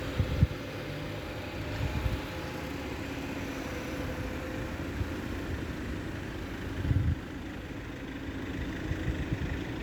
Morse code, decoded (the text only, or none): none